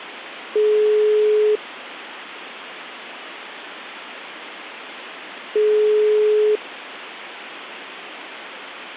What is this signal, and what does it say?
Telephone call progress tone (single-tone plan, as in most of Europe), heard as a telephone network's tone, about 420 Hz, 1 s on and 4 s off. Ringback tone.